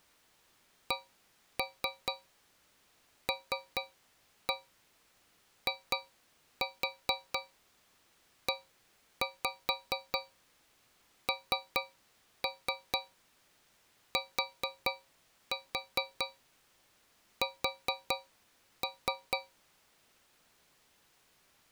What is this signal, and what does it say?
Tap code, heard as taps on a metal pipe, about 4 knocks a second. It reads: CLIENTS